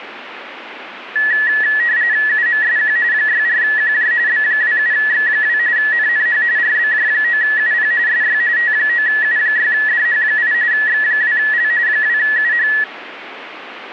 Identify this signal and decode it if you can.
RTTY (45.45 baud, 170 Hz shift), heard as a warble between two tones, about 1800 Hz centre, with radio static. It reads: UMSQ 64QJ B27X2 NNH RBJ9UP SY T9U6DH8 X2L 2UH